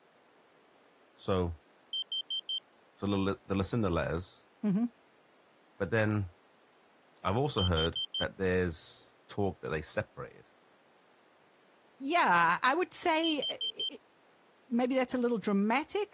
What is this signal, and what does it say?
Alarm pattern, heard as an alarm's beeps, played three times, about 3150 Hz, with speech in English. Temporal four. Carbon monoxide.